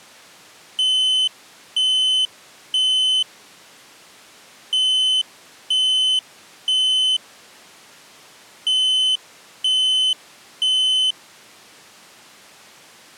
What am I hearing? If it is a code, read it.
Alarm pattern, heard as an alarm's beeps, played three times, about 3050 Hz. Temporal three. Smoke or fire, evacuate.